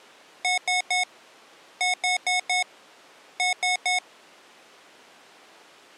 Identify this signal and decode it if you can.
Beep code, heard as beeps from a small speaker, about 730 Hz. 3-4-3.